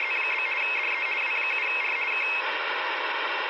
RTTY (50 baud, 450 Hz shift), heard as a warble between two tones, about 2350 Hz centre, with radio static. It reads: … DE W7R K